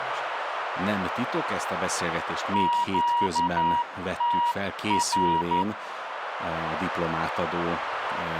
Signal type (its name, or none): Morse code